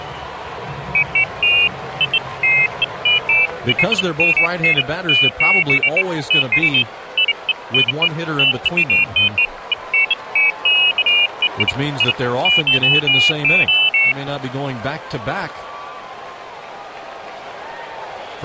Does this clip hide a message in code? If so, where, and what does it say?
No, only pairs of high tones at irregular times.